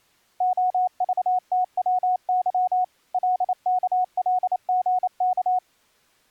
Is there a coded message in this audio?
Yes: Morse code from 0.3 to 5.6 s, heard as a keyed tone, machine-sent, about 28 wpm, 730 Hz. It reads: OVTWY LKLGK